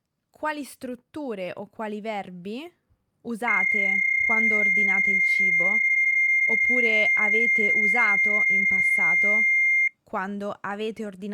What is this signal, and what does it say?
PSK31 (31.25 baud), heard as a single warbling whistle, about 2100 Hz, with speech in Italian.